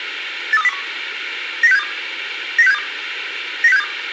Five-tone selective call (EEA), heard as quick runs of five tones, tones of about 40 ms, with radio hiss and a squelch burst at the end. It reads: 83201 90672 90672 90672